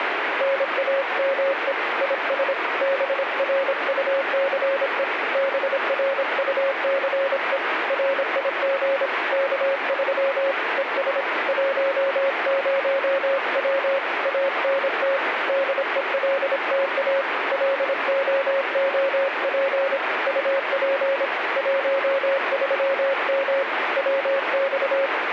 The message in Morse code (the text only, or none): NAME IS BRUCE BRUCE RIG K3 ES 10W ANT DELTA LOOP UP 13M WX